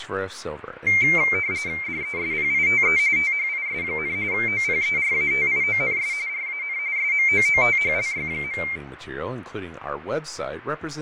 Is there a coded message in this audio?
Yes: RTTY (45.45 baud, 170 Hz shift) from 0.9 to 8.8 s, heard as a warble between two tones, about 2200 Hz centre, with fading and speech in English. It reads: DESPITE THIS, OPERATIONS RAN SMOOTHLY.